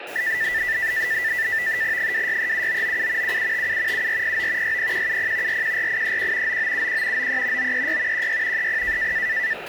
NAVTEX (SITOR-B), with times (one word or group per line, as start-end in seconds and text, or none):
2.0-3.4 2637997
3.2-4.1 7757
3.9-4.8 7409
4.6-5.6 60170
5.5-6.6 414831
6.5-7.3 9971
7.2-7.7 93
7.6-8.3 936
8.1-8.7 16
8.6-9.1 30